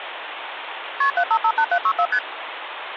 Multi-frequency trunk signalling (R1, as on North American trunks), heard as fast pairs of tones, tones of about 70 ms, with phone line noise. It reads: KP 7558764 ST